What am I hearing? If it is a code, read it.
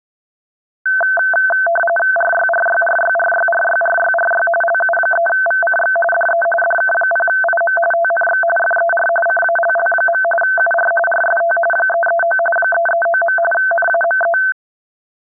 RTTY (45.45 baud, 850 Hz shift), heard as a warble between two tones, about 1100 Hz centre. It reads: RYRYRYRYRYRYRY LU3VCX DE DK0IM TNX FER CALL. UR RST 339 339. NAME